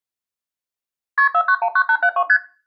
Multi-frequency trunk signalling (R1, as on North American trunks), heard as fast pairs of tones, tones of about 70 ms. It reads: KP 4919872 ST